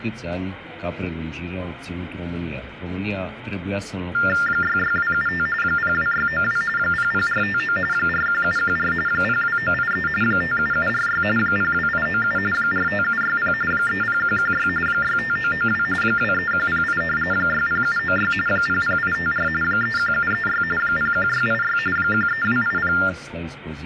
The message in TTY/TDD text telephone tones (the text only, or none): 66275 02692 00459 41714 02983 57746 02897 45760 30116 65992 23108 60796 00854 31736 01686 13280